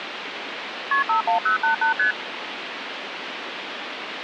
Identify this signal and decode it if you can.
Multi-frequency trunk signalling (R1, as on North American trunks), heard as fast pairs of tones, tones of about 120 ms, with phone line noise. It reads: KP 51088 ST